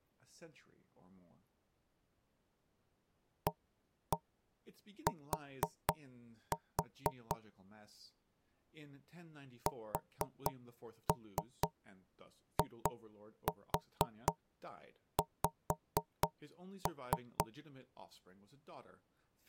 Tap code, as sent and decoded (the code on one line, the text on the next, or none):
1-1 4-4 / 4-3 2-4 5-3
AT SIX